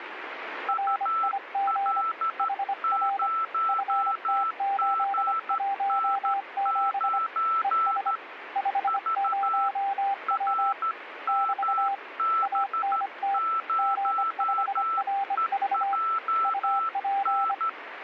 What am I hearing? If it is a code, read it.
Morse code, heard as two keyed tones, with radio static. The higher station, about 13 wpm, 1330 Hz: UL0GN9 V RMB0EJN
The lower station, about 25 wpm, 790 Hz: RIG HR FT817 ES 50W <BT> ANT G5RV UP